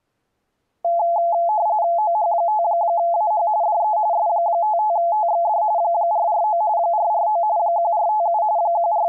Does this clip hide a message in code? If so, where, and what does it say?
Yes: RTTY (45.45 baud, 170 Hz shift) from 0.8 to 9.1 s, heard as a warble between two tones, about 770 Hz centre. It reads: OH5AH DE S55TXD 449 449 1457 …